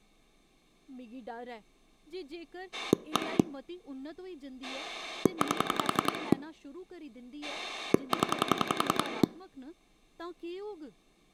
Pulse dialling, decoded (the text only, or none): 1 8 0